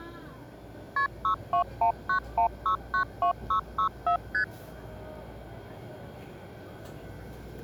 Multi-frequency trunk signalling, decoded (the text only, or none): KP 62191692664 ST